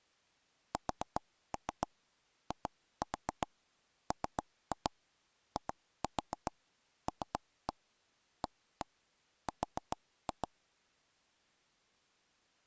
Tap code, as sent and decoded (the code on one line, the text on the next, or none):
4-3 2-4 3-2 2-4 3-1 1-1 4-2
SIMILAR